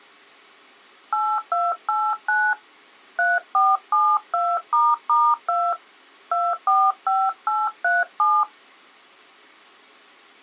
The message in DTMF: 8289 3472**2 245837

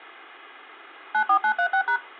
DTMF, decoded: 94936#

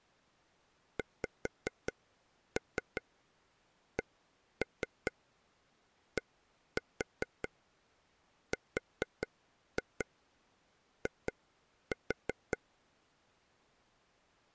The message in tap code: XCDRI

